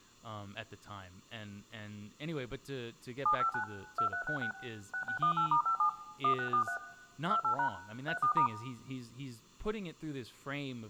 DTMF, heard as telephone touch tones, dialled by machine, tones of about 100 ms, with room echo and speech in English. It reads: 759 2366 6618*57 1643 28# 34*